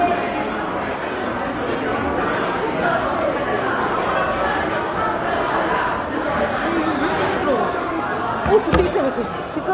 The noise of a crowd indoors. There is no code.